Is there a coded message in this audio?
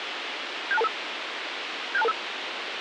Yes: five-tone selective call (EIA) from 0.7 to 2.1 s, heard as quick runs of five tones, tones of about 30 ms, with radio hiss. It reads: 76225 76225